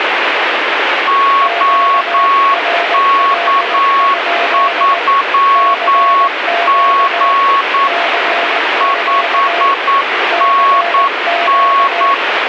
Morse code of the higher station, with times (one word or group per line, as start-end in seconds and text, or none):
1.1-7.9 OK3G
8.8-12.1 5NN